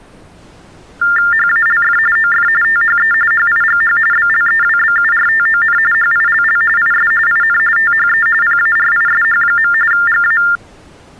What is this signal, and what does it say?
TTY/TDD text telephone tones (45.45 baud Baudot), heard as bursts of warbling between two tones, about 400 Hz shift, 1600 Hz centre. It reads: HALF OF THE HIGH BLEWBURTON HILL IS IN THE PARISH. GA